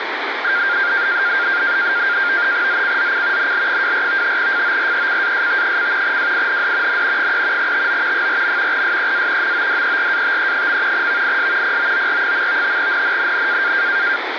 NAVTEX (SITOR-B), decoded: ZCZC NL24 FORECAST: WIND N 3 TO 4. SEA MODERATE. VIS POOR. NNNN

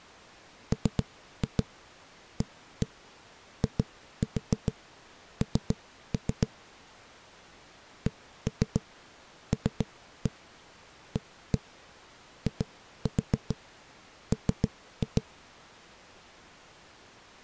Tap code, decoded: MAIN CLAIM

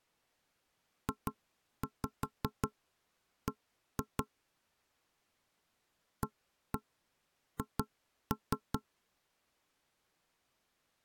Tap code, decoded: JB AH

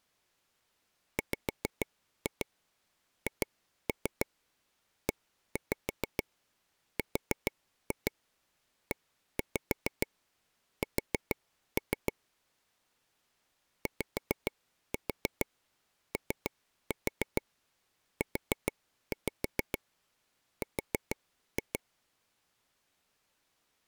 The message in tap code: WHERES YOUR

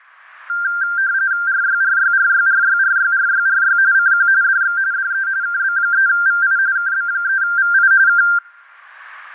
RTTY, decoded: RYRYRYRYRYRYRY CQ DX DE KB3VI KB3VI K

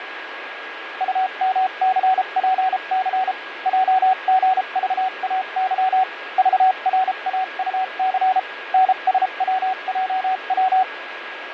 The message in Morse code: UMCPC JGVAY VRAUC NSWJW

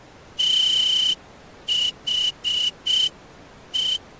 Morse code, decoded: THE

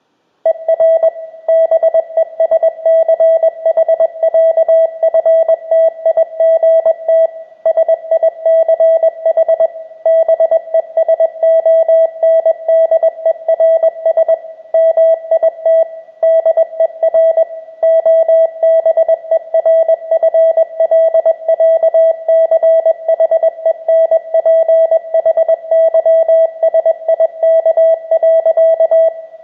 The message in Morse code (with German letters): ER BESCHÄFTIGT SICH BESONDERS MIT DER OBERFLÄCHENPHYSIK.

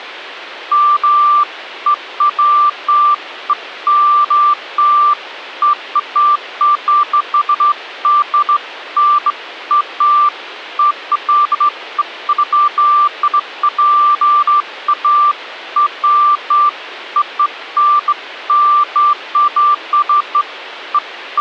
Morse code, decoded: none

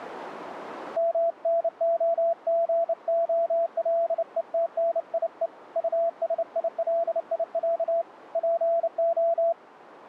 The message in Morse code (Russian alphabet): МНОГОЛЕТНИЕ УСИЛИЯ ПО

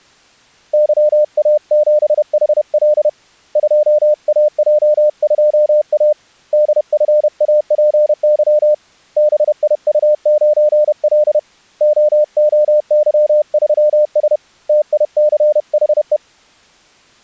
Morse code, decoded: YA7HL 2AJ2A DFAPY BIU9L OOY3S TICHE

